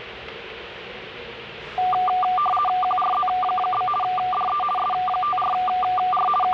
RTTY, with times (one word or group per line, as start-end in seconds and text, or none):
2.8-3.9 QRZ?
4.0-4.6 DE
4.8-6.3 S54R
6.4-6.5 …